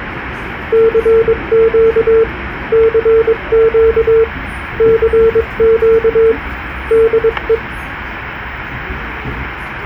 Morse code, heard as a keyed tone, hand-sent with a paddle, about 22 wpm, 450 Hz, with the noise inside a subway train. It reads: CQ CQ CQ DE